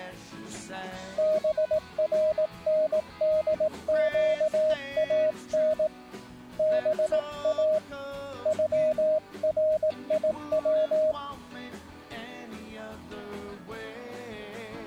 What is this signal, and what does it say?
Morse code (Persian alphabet), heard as a keyed tone, hand-sent with a paddle, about 18 wpm, 620 Hz. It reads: برندگان با غریو